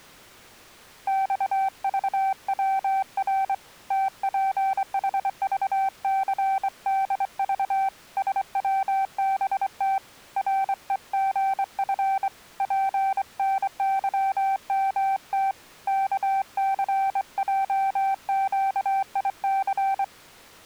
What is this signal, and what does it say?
Morse code, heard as a keyed tone, hand-sent with a straight key, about 24 wpm, 780 Hz. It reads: XVWR TPHVCDV SWBT REGF PNYMT KCJQIC